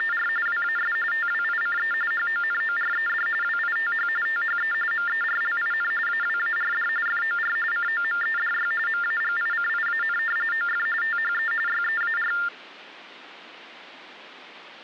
TTY/TDD text telephone tones (45.45 baud Baudot), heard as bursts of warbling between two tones, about 400 Hz shift, 1600 Hz centre. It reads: … WAS TWICE HONORED WITH THE MERLIN AWARD FOR COMEDY MAGICIAN OF THE YEAR